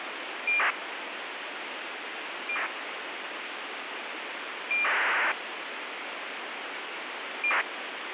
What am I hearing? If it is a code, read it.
ACARS aircraft data, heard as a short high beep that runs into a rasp, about 2400 baud, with radio hiss.